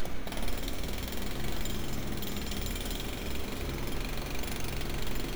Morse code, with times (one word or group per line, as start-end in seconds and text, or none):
none